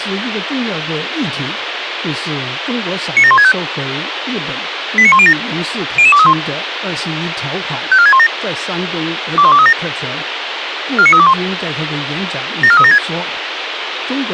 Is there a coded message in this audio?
Yes: five-tone selective call (ZVEI) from 3.2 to 13.0 s, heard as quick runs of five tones, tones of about 70 ms, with radio hiss and speech in Chinese. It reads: 97165 89107 00231 54617 21237 49321 74376